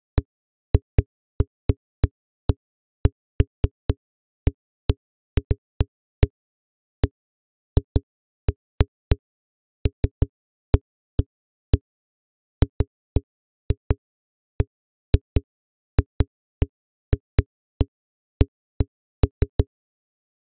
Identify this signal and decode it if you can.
Irregular knocks on a wall. There is no code.